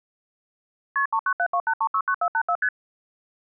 Multi-frequency trunk signalling (R1, as on North American trunks), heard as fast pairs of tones, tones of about 70 ms. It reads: KP 39728369484 ST